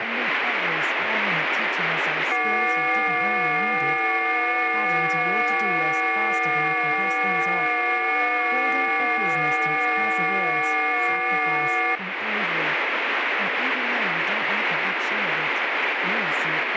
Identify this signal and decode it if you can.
FT8 (several signals at once), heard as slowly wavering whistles, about 6.25 baud, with radio static.